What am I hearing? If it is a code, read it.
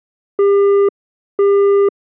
Telephone call progress tone (single-tone plan, as in Europe, Japan and elsewhere), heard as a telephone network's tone, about 400 Hz, 0.5 s on and 0.5 s off. Busy tone.